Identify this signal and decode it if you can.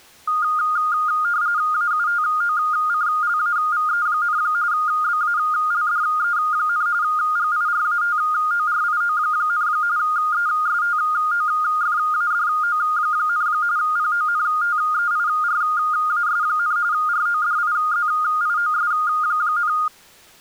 RTTY (45.45 baud, 170 Hz shift), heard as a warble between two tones, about 1320 Hz centre. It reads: AUTOCLAVE, BALDE, GIRATORIO, ESTOFADO, PONTEIRAS, RODIZIOS,